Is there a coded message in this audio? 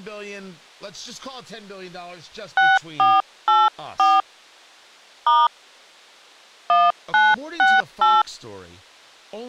Yes: DTMF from 2.6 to 8.2 s, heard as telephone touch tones, dialled by hand, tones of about 200 ms, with speech in English. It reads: 6484 * 1968